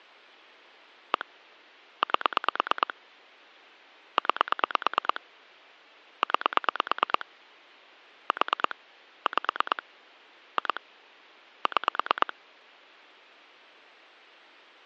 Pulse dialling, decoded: 1 8 9 9 4 5 2 6

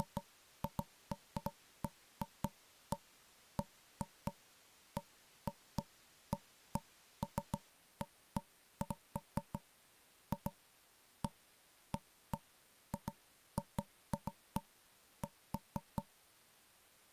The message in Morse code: none

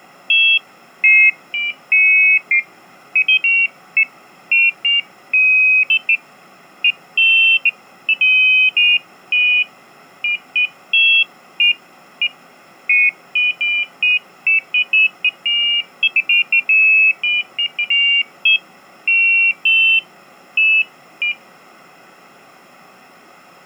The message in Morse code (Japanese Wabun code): none

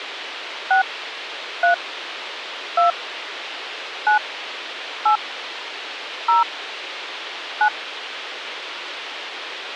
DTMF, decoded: 6 3 2 9 8 0 9

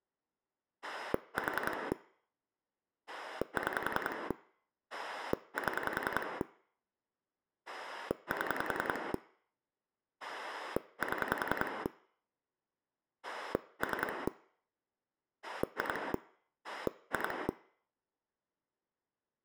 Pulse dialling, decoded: 4 6 7 7 7 3 2 2

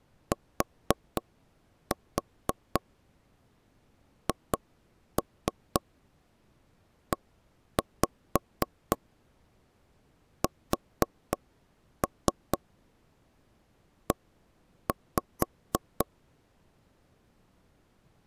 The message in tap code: THESE

